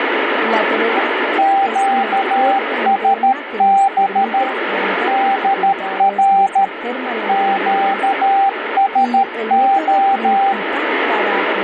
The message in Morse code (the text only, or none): QSB DR QSO